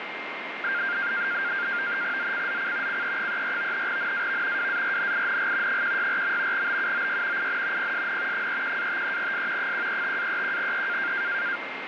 NAVTEX (SITOR-B), 100 baud, 170 Hz shift, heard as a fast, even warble, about 1500 Hz centre, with radio static and a steady whistle near 2110 Hz. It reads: ZCZC CE34 NAV WARNING 164. BUOY IN PSN 31-53S 135-31E